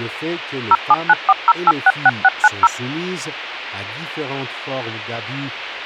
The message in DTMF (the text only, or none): 07940866690